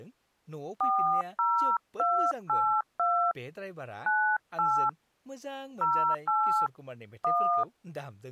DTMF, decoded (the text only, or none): 40282 98 08 1